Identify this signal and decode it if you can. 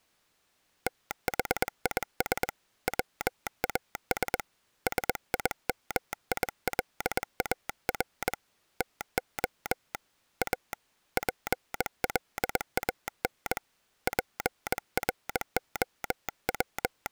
Morse code, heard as a telegraph sounder, hand-sent with a bug key, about 21 wpm. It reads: THIS WAS SIMILAR TO A PLAN …